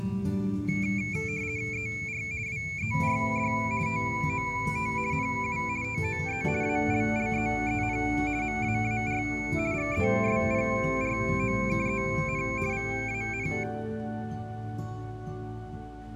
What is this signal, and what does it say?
RTTY (50 baud, 170 Hz shift), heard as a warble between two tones, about 2300 Hz centre. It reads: ER WERD TOT NU TOE ALLEEN MAAR GESPROKEN VAN